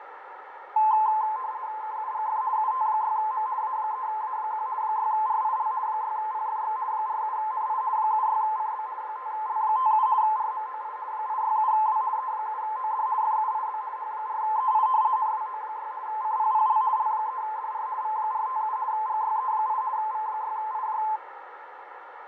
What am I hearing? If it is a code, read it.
RTTY (50 baud, 170 Hz shift), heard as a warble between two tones, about 950 Hz centre, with radio static, fading and a narrow filter. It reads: KUGF UT6M A3A1 6RIL 6PFX 47NI 76CB 5L57 RMOI 867W E7OD FUIB H4EI NWO6 CPPL L3DR V457 GYE8 V6IJ